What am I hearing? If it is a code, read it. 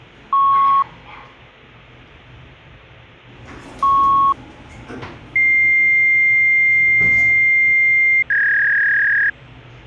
Fax machine handshake, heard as beeps, a long tone and a warble, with the noise inside a lift.